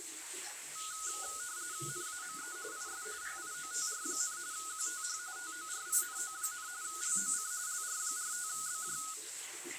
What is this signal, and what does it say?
RTTY (45.45 baud, 170 Hz shift), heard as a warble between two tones, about 1360 Hz centre, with radio static and the noise of a restroom. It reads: NAME IS PIOTR, QTH TORINO, LOC LR45BJ